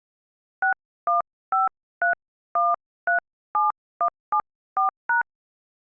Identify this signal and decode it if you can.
DTMF, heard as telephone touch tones, dialled by hand, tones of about 130 ms. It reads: 6153137174#